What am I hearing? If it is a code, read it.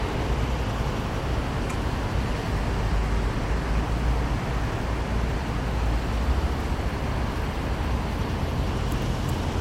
Street noise. There is no code.